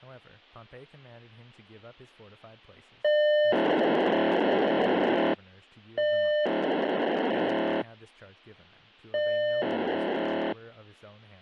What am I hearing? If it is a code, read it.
POCSAG pager data (1200 baud), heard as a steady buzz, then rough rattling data, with a squelch burst at the end and speech in English.